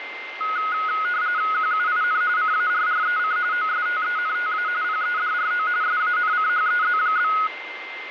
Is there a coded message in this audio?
Yes: RTTY (45.45 baud, 170 Hz shift) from 0.4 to 7.5 s, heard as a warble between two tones, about 1360 Hz centre, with radio static and a steady whistle near 2090 Hz. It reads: QUIN CARREC OSTENTA PEDRO SANCHEZ?